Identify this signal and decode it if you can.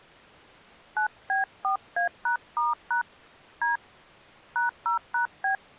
DTMF, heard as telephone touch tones, dialled by hand, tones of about 140 ms. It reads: 9B4A#*# D #0#B